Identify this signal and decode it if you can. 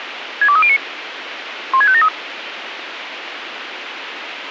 Five-tone selective call (ZVEI), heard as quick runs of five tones, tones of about 70 ms, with radio hiss. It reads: 62309 16573